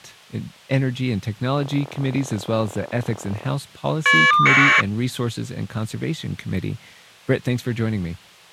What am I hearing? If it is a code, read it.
Caller ID data burst, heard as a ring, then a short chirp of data, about 1200 baud, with speech in English.